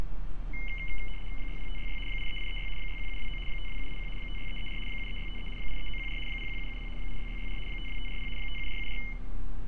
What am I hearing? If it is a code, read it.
RTTY (75 baud, 850 Hz shift), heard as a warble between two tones, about 2550 Hz centre, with radio static, room echo and street noise. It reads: 60566 83836 61729 52781 56334 73653 83914 01770 86664 52540 57474